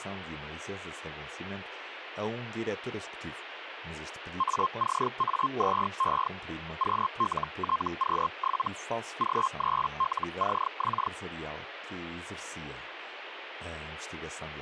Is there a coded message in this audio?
Yes: Hellschreiber (Feld-Hell, 122.5 baud) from 4.4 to 11.1 s, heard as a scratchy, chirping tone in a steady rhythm, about 1060 Hz, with radio static and speech in Portuguese. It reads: ACA2E QLTQ7 G3LCX